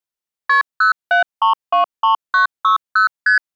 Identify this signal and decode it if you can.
Multi-frequency trunk signalling (R1, as on North American trunks), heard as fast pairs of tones, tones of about 120 ms. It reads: KP 07323960 ST